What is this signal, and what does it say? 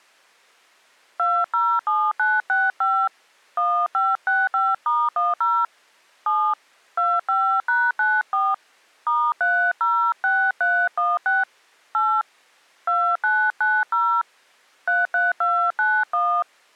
DTMF, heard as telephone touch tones, dialled by hand, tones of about 250 ms. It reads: 207965 1565*10 7 25#94 *306316 8 2990 33291